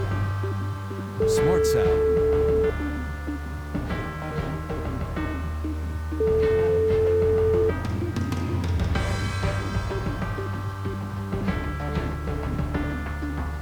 Telephone call progress tone (single-tone plan, as in most of Europe), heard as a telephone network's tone, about 440 Hz, 1.5 s on and 3.5 s off. Ringback tone.